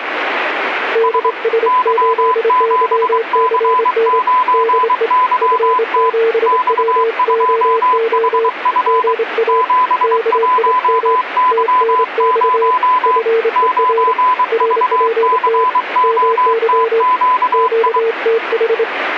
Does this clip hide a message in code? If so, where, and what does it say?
Yes: Morse code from 0.9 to 18.9 s, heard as two keyed tones, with radio static. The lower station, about 26 wpm, 450 Hz: DS8YCN DE F7WOO GA KIM TNX FER RPT MY QTH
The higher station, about 23 wpm, 1010 Hz: S Y7C9YT X2HF 71Y0 9VCOTQI